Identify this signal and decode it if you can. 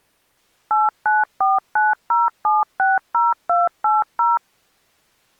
DTMF, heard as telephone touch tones, dialled by machine, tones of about 180 ms. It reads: 89490760280